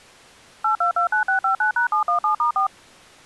DTMF, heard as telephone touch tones, dialled by machine, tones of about 110 ms. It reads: 8229659#717*4